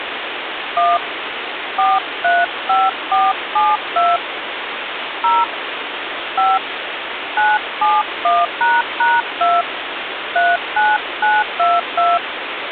DTMF, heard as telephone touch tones, dialled by hand, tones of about 200 ms, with phone line noise. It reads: 1 435472 0 5 971##2 39922